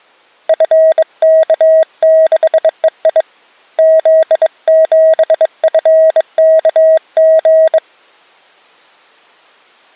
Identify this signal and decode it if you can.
Morse code, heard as a keyed tone, hand-sent with a bug key, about 22 wpm, 640 Hz. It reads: FK6EI Z7FKG